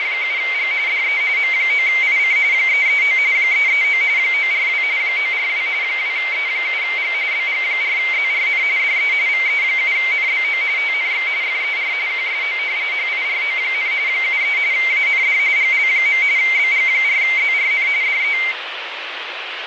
RTTY (45.45 baud, 170 Hz shift), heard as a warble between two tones, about 2200 Hz centre, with radio static. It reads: … DE M9IC 339 339 942 942 2E7G BG4ZRN DE VE7NBO TNX FER QSO HIRO, 73 AND GL. BG4ZRN DE